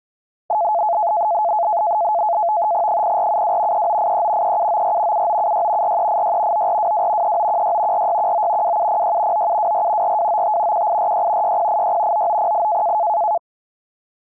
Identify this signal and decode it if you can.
NAVTEX (SITOR-B), 100 baud, 170 Hz shift, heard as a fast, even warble, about 770 Hz centre. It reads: 0472 3983 3794 7976 4386 9422 3916 4619 2706 9724 4295 1846 6086 9908